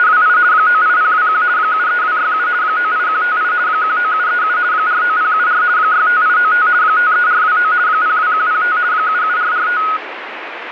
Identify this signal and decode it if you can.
RTTY (50 baud, 170 Hz shift), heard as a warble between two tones, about 1360 Hz centre, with radio static. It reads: … 98021 73267 98158 19737 49074 65895 53429 02105 77445